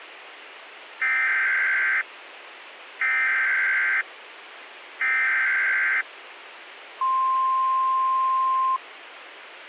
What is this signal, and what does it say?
Emergency Alert System (SAME) tones (header bursts, then the 1050 Hz attention tone), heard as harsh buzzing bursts, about 520.83 baud, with radio hiss.